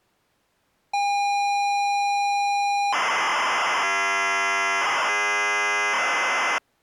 ZX Spectrum tape loading, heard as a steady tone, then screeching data.